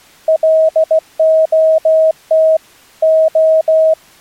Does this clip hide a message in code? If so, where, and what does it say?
Yes: Morse code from 0.2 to 4.0 s, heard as a keyed tone, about 16 wpm, 640 Hz. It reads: LOT O